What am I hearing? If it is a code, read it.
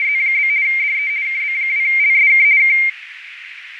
RTTY (50 baud, 170 Hz shift), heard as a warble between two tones, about 2200 Hz centre, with radio static, fading and a narrow filter. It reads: … DE KB2LSK K